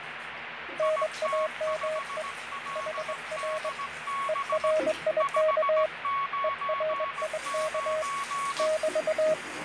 Morse code, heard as two keyed tones, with radio static, fading and the noise of a restroom. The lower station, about 21 wpm, 620 Hz: NAME HR ERIK ERIK <BT>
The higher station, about 17 wpm, 1110 Hz: IT5LDB 599